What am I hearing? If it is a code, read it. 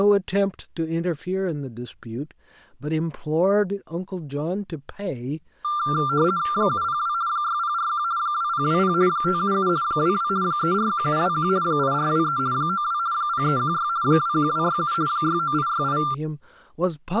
RTTY (50 baud, 170 Hz shift), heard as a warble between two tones, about 1280 Hz centre, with speech in English. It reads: 702 6041 2020 577 22 341721 8423 92 0316 21267 69868